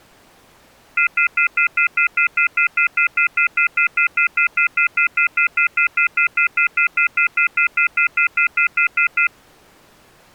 Telephone call progress tone (North American plan), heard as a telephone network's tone, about 1400, 2050, 2450, 2600 Hz, 0.1 s on and 0.1 s off. Off-hook warning tone.